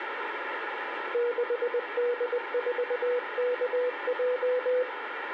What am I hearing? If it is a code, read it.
Morse code, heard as a keyed tone, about 20 wpm, 490 Hz, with radio static and room echo. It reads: 6D4KJ